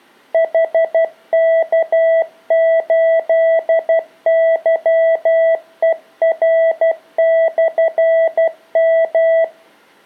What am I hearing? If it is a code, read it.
Morse code, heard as a keyed tone, hand-sent with a paddle, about 12 wpm, 660 Hz. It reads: HK8YER/M